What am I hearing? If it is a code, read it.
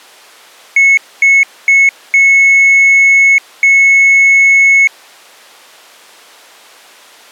Beep code, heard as beeps, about 2200 Hz. 3 short, 2 long.